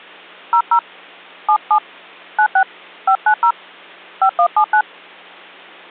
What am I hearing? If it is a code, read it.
DTMF, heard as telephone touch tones, dialled by hand, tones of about 80 ms. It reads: 00 77 96 590 5179